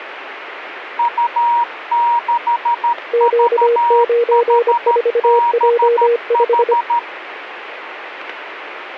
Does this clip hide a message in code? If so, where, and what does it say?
Yes: Morse code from 0.9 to 7.1 s, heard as two keyed tones, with radio static. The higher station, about 13 wpm, 950 Hz: U6VHBH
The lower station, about 25 wpm, 470 Hz: Q94J5